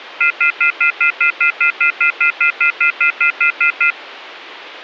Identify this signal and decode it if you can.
Telephone call progress tone (North American plan), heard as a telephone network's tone, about 1400, 2050, 2450, 2600 Hz, 0.1 s on and 0.1 s off. Off-hook warning tone.